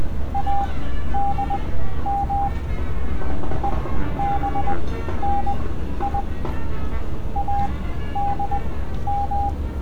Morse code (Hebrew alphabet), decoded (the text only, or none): אדם ובני אדם